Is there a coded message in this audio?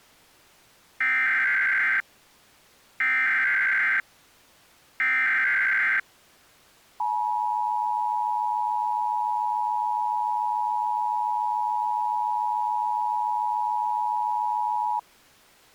Yes: Emergency Alert System (SAME) tones (header bursts, then the 853 and 960 Hz attention tone) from 1.0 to 15.0 s, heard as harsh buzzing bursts, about 520.83 baud.